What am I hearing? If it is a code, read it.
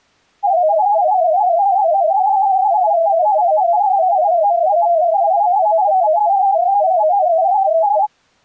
Multi-tone FSK (Olivia or MFSK type), about 250 Hz wide, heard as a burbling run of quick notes, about 31.25 baud.